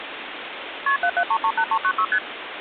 Multi-frequency trunk signalling (R1, as on North American trunks), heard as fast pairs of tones, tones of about 70 ms, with phone line noise. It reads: KP 77338396 ST